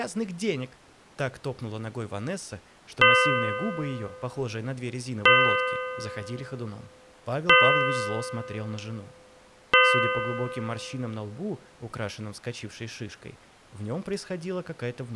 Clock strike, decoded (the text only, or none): 4